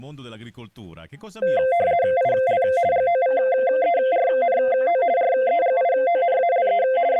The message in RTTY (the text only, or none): IL GOVERNO REGIONALE …